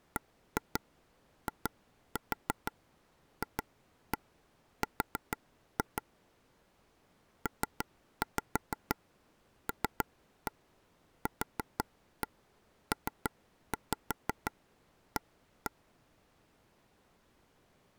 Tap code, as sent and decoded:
1-2 2-4 2-1 4-2 / 3-5 3-1 4-1 3-5 1-1
BIFR PLQPA

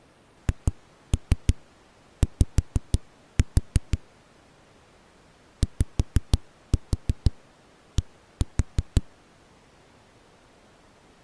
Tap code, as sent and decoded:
2-3 5-4 / 5-4 1-4
HY YD

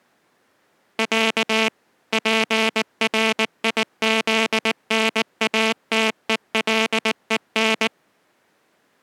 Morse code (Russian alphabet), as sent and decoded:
.-.- / .--. .-. .. --.. -. .- - . .-.. . -.
Я ПРИЗНАТЕЛЕН

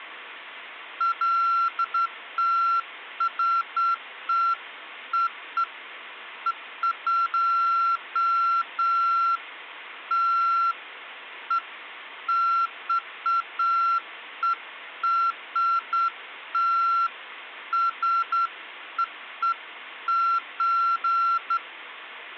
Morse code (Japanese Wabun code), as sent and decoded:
none

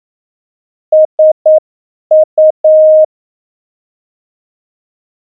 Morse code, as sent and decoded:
... ..-
SU

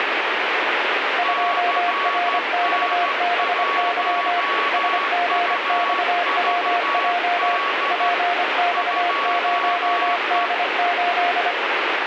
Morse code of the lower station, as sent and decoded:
..--- .-. -..- -... -.-- / ... --. -..- .-- .--- / .--. -..- ----- -.. ---..
2RXBY SGXWJ PX0D8

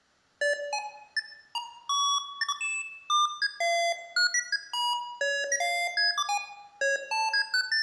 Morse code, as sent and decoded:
none

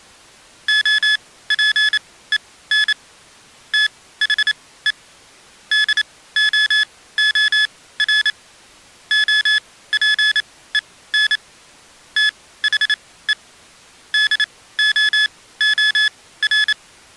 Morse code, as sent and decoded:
--- .--. . -. / - .... . / -.. --- --- .-. / --- .--. . -. / - .... . / -.. --- --- .-.
OPEN THE DOOR OPEN THE DOOR

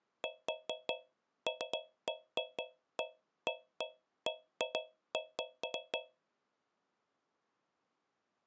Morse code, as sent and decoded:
none

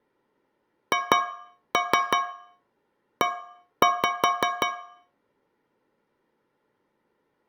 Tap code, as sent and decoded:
2-3 1-5
HE

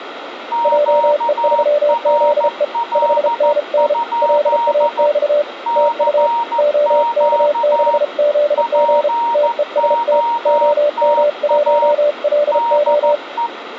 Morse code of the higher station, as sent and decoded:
--.- .-. .-.. ..--.. / -.-. --.- / .--. --- - .- / -.. .
QRL? CQ POTA DE

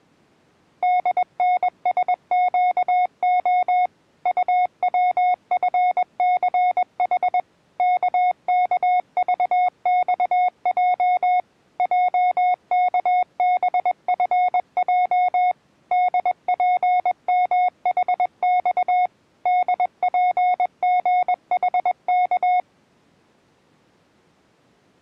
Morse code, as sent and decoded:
-.. -. ... --.- --- / ..- .-- ..-. -.-. .... / -.- -.- ...- -..- .--- / .--- -.- -... ..-. .--- / -.. .--. -- .... -..- / -.. .--. --. .... -.-
DNSQO UWFCH KKVXJ JKBFJ DPMHX DPGHK

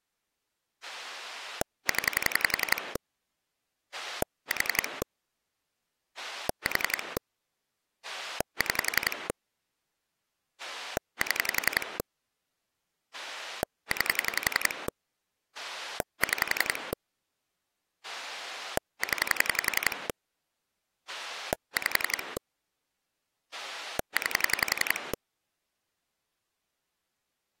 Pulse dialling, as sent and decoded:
10 / 4 / 4 / 6 / 7 / 9 / 6 / 10 / 5 / 9
0 4 4 6 7 9 6 0 5 9

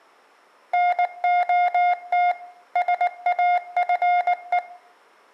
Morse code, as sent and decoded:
-. --- - / ... .- ..-. .
NOT SAFE

